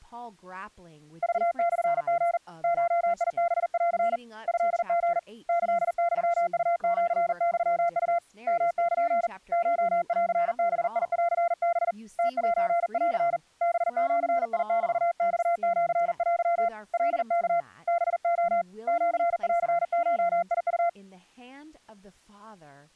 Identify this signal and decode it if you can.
Morse code (Japanese Wabun code), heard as a keyed tone, hand-sent with a paddle, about 40 wpm, 690 Hz, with speech in English. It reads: クモリ ゴハン トリ キユウシユウ ヨル コンバンハ ムセン ハジメマシテ カワ ハレ シンゴウ